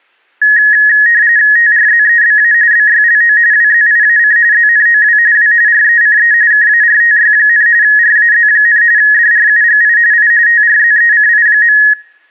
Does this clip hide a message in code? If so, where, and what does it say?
Yes: RTTY (45.45 baud, 170 Hz shift) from 0.4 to 11.9 s, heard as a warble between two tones, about 1800 Hz centre. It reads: TRZEBA BYLO WZIAC ZNOW W RECE KARTY, RAZ, DRUGI I TRZECI.